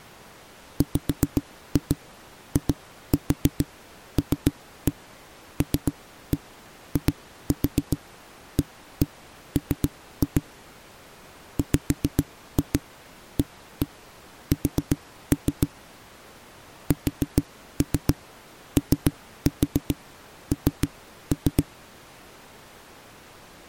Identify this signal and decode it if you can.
Tap code, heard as knocks on a wall, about 7 knocks a second. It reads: WILLIAM WAS SON